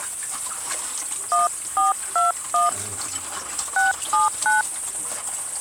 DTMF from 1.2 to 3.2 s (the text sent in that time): 1421